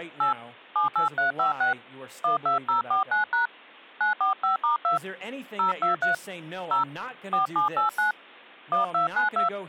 DTMF, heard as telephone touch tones, dialled by hand, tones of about 130 ms, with speech in English. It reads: 8 78356 12049# 945*2 023 0 4789 1292